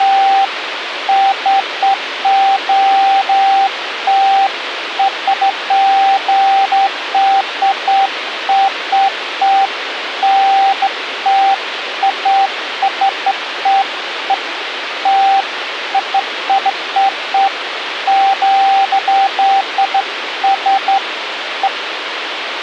Beeps of irregular length, with radio hiss. There is no code.